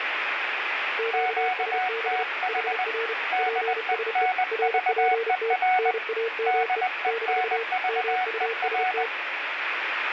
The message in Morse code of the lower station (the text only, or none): QSB HR PSE RPT NAME - MUST